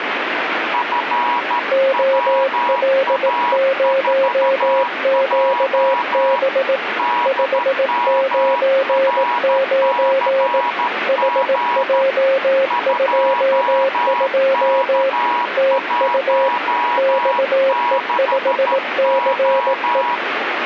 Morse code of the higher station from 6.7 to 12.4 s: DMRCG

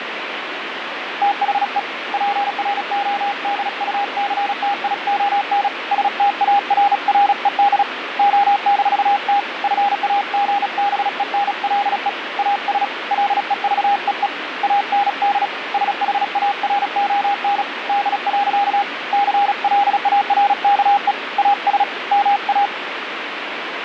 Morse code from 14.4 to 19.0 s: AND SHARON D.

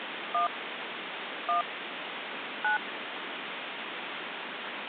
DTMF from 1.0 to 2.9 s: 1 9

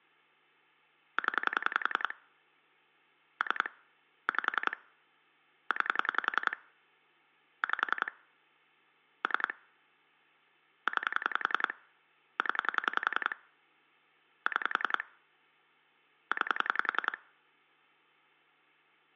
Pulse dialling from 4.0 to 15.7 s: 5 9 5 3 9 0 6

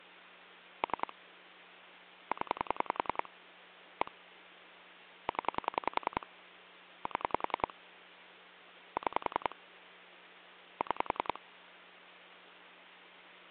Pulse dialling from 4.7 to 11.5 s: 0 7 6 6

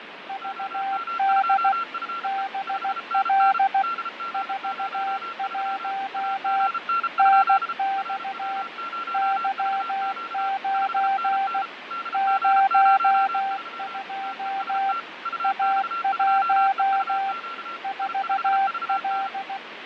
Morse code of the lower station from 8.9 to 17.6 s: Y9 02 A1

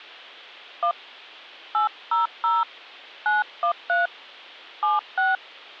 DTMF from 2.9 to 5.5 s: 913 76

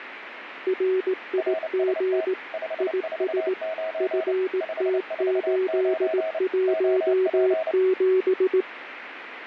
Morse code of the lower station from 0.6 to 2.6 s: RIG

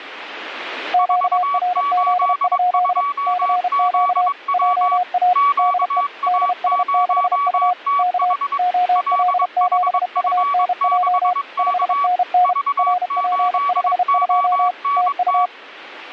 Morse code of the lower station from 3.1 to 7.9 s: CQ JA DE DS6U

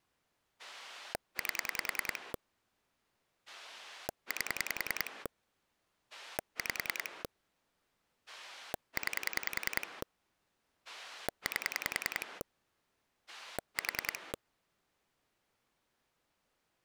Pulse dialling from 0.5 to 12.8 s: 8 8 5 9 8

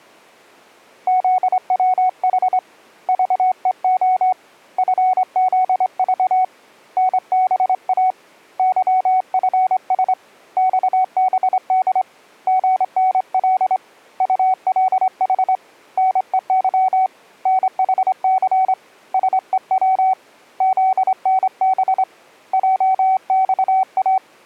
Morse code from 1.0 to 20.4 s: ZWH VEO FZV NBA YFS XBD GNL ULH NEY NHC SEW

